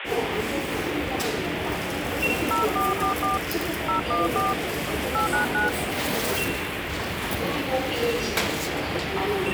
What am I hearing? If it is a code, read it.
DTMF, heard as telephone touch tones, dialled by hand, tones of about 140 ms, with phone line noise and the noise of a crowd indoors. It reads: 0444 014 899